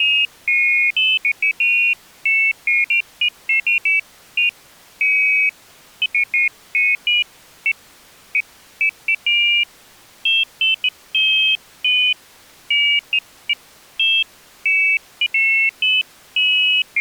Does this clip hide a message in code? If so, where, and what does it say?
No, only pairs of high tones at irregular times.